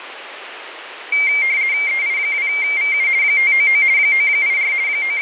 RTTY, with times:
1.9-3.1 EI2VU
3.2-3.8 599
4.0-4.7 984
4.9-5.2 …

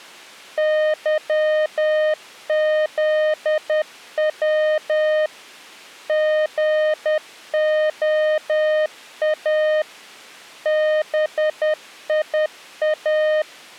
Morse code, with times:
0.6-5.3 YZW
6.1-9.8 GOA
10.7-13.4 BIA

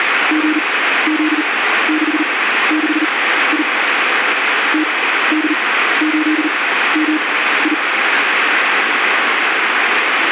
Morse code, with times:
0.3-3.6 GZ66I
4.7-7.7 TD8MI

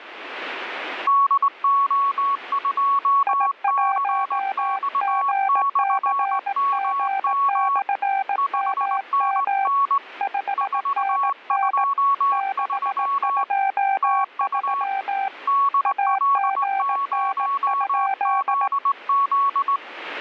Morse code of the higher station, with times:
1.1-7.8 DO2CX/MM
8.4-10.0 5NN
10.6-13.4 423
14.0-14.8 TU
15.5-19.8 DL0ZZ

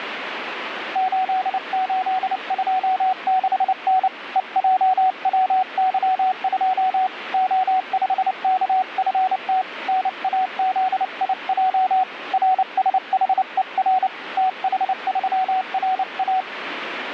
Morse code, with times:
1.0-4.1 8826N
4.4-7.1 EJWY2
7.3-9.6 O5KFT
9.9-12.0 NAZIJ
12.3-14.1 RSHER
14.4-16.4 TH3RA

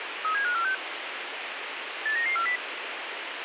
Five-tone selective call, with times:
0.2-0.7 37546
2.1-2.6 89940

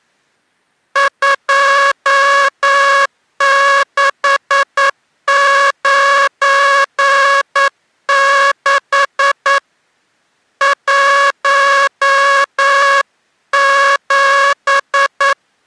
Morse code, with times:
1.0-9.6 2696
10.6-15.3 17

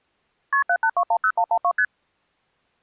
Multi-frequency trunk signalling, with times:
0.5-0.6 KP
0.7-1.7 78210112
1.8-1.8 ST

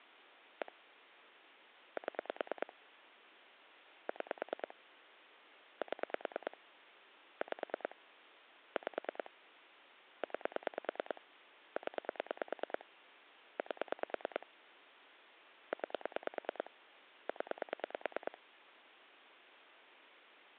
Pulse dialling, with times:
0.6-0.7 1
2.0-2.7 7
4.1-4.7 6
5.8-6.6 7
7.4-8.0 5
8.8-9.3 5
10.2-11.2 9
11.8-12.9 0
13.6-14.5 8
15.7-16.7 9
17.3-18.4 0

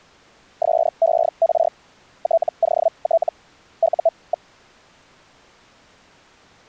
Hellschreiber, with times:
0.6-1.7 SER
2.2-3.3 TOT
3.8-4.5 U.

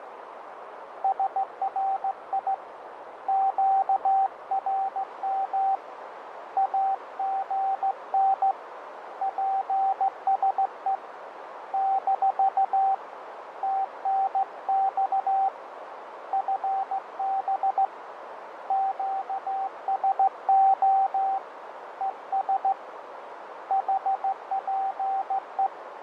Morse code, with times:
1.0-2.5 SRI
3.3-5.7 QRM
6.6-8.5 AGN
9.2-10.9 PSE
11.7-12.9 -
13.6-15.5 TNX
16.3-17.8 FB
18.7-21.4 QSO
22.0-22.7 ES
23.7-25.7 HPE

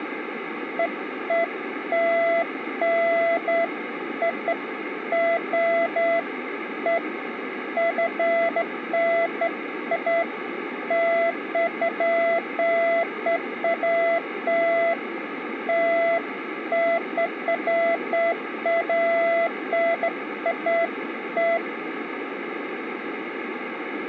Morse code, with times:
none

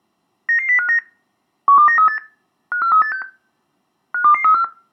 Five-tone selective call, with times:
0.5-1.0 99059
1.7-2.2 12938
2.7-3.2 54386
4.1-4.6 52234

